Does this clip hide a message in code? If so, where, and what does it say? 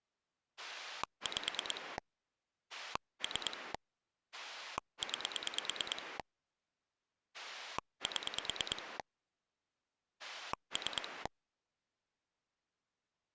Yes: pulse dialling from 0.6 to 11.3 s, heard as a rotary dial, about 9 pulses a second. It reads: 5 3 9 7 3